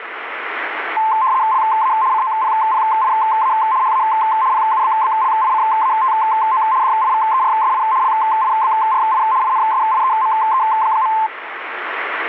RTTY (75 baud, 170 Hz shift), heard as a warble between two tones, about 960 Hz centre, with radio static. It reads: LA COPPIA HA PUBBLICATO DIVERSI LIBRI INSIEME.